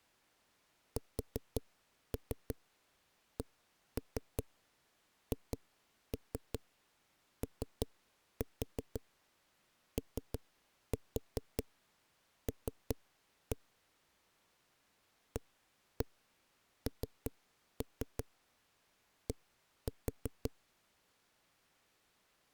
Tap code, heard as knocks on a wall, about 5 knocks a second. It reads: SCHOOL AND